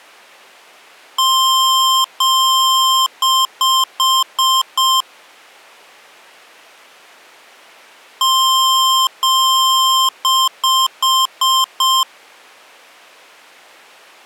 Beep code, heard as beeps from a small speaker, played twice, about 1050 Hz. 2 long, 5 short.